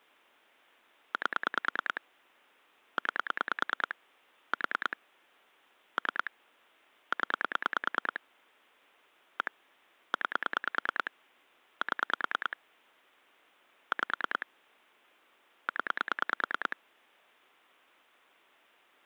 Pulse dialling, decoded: 8 9 4 3 0 1 9 7 5 0

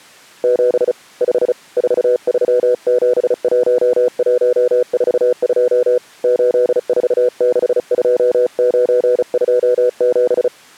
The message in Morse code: 7 5 4371142 8462927

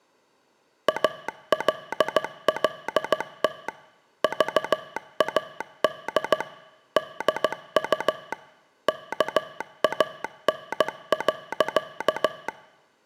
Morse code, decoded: ALLT VAD DU KAN.

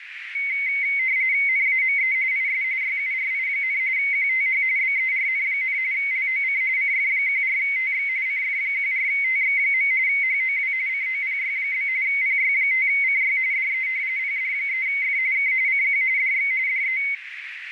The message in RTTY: NAME IS YURI, QTH BERN, LOC CF14TX CF14TX. HOW COPY? PY5CY DE PD3F K CQ DX DE

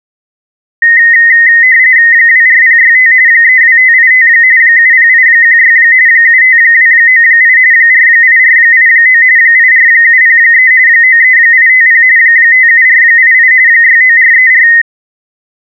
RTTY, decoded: 24065 32585 70816 75298 48489 84703 93850 57488 69434

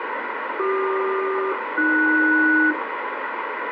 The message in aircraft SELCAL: CQ-AS

